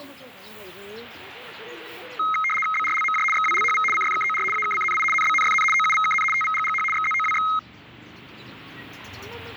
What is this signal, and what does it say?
RTTY (75 baud, 850 Hz shift), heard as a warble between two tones, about 1700 Hz centre, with the noise of a residential street. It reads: BRLMJ XWLHV CFKOR AKCNI NBNFN OUVKN TVGGH XZOWX